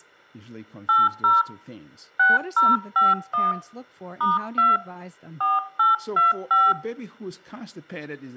DTMF, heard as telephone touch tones, dialled by hand, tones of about 180 ms, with room echo and speech in English. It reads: 80 6051 *2 4825